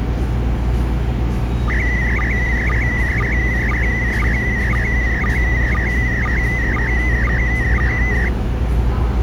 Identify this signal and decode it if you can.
SSTV (slow-scan television), PD 120, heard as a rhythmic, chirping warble, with the noise of a subway station.